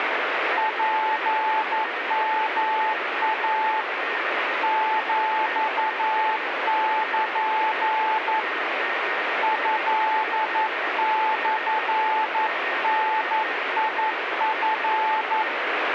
Morse code (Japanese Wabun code), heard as a keyed tone, hand-sent with a paddle, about 11 wpm, 870 Hz, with radio static and a weaker station near 1850 Hz. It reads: ツヨイ ヒル トモダチ